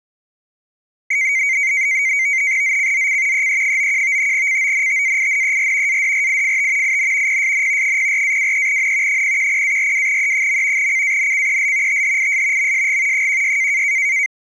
NAVTEX (SITOR-B), 100 baud, 170 Hz shift, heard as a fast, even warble, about 2150 Hz centre. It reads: ZCZC EE91 CONTAINER ADRIFT IN PSN 04-23N 010-42E. CANCEL THIS MSG 16